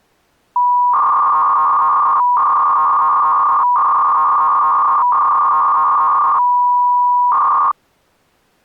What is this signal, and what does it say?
300-baud modem data (V.21 tones), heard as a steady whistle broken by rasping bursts, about 300 baud, 200 Hz shift.